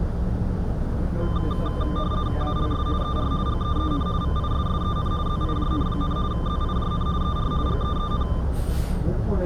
RTTY (50 baud, 170 Hz shift), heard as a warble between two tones, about 1110 Hz centre, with room echo and the noise inside a bus. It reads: ALS ER GEEN VISSEN ZIJN, ZIJN ER GEEN